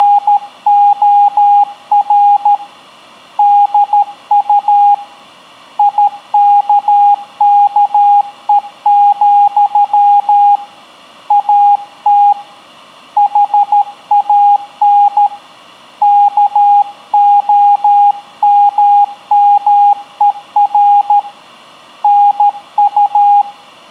Morse code, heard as a keyed tone, hand-sent with a paddle, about 13 wpm, 820 Hz, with room echo. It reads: … DU IKKE, AT HAN KOMMER NU